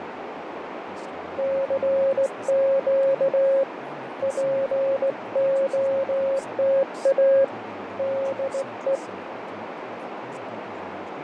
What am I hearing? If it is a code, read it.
Morse code, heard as a keyed tone, hand-sent with a straight key, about 17 wpm, 540 Hz, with radio static, fading and a narrow filter. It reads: CQ POTA DE